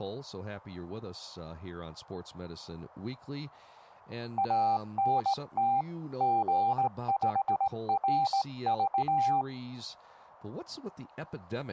Morse code, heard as a keyed tone, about 18 wpm, 790 Hz. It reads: ANT G5RV